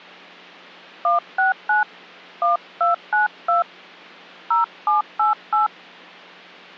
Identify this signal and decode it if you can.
DTMF, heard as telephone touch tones, dialled by hand, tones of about 140 ms. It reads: 169 1292 0788